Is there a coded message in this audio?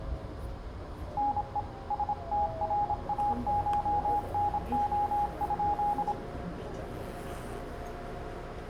Yes: Morse code (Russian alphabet) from 1.1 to 6.2 s, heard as a keyed tone, hand-sent with a paddle, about 26 wpm, 830 Hz, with room echo and the noise inside a subway train. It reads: НЕ СТРАШНО?